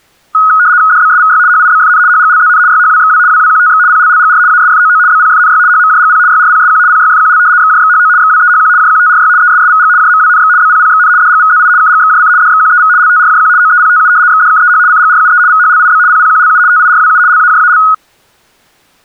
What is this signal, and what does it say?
RTTY (75 baud, 170 Hz shift), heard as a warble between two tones, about 1360 Hz centre. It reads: DBSVY HIBFN HGLZN YHWXW WWQTX PLLGR ASFOO BPFNY HMJGP YRPSQ PYFQL XJXHO XWEHQ JQTRY ESSVG JMWNX BPPXN DGVZI KGXJC DXQEV LTRJQ OEPTU XDKEH CGRUE VHLIB PPQLU TIRWU LAJAL